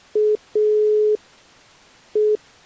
Telephone call progress tone (pulsed, as in Italy), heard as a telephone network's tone, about 420 Hz. Dial tone.